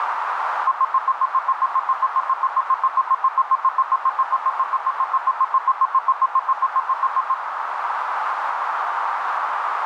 Evenly repeated beeps, with radio static and a narrow filter. There is no code.